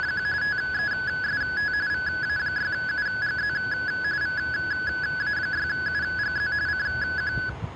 RTTY (45.45 baud, 170 Hz shift), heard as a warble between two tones, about 1600 Hz centre, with the noise of a residential street. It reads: … TEST VA6UGZ VA6UGZ CQ